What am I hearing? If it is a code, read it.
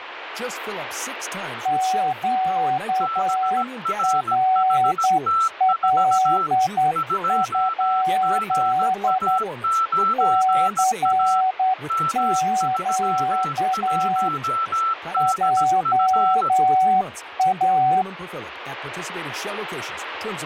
Morse code, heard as two keyed tones, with radio static and speech in English. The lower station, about 10 wpm, 750 Hz: QRL? CQ JA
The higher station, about 17 wpm, 1330 Hz: BRHT4 2GA9A M31DF